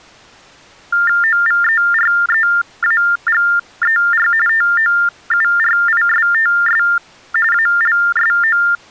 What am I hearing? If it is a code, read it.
TTY/TDD text telephone tones (45.45 baud Baudot), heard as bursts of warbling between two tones, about 400 Hz shift, 1600 Hz centre. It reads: OVEREAGER TOURISTS ALSO